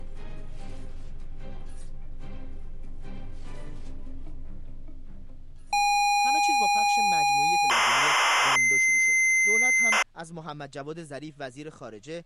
ZX Spectrum tape loading, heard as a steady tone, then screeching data.